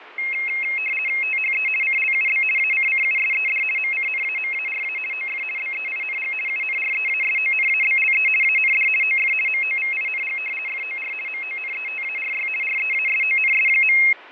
RTTY (50 baud, 450 Hz shift), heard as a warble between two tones, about 2350 Hz centre, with radio static and fading. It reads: THE CLUB ACCUSED MCNAMARA OF BEING UNREASONABLE AND OF MOVING FOR MONETARY REASONS.